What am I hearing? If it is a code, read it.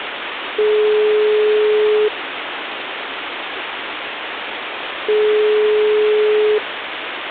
Telephone call progress tone (single-tone plan, as in most of Europe), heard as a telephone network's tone, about 420 Hz, 1.5 s on and 3 s off, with phone line noise. Ringback tone.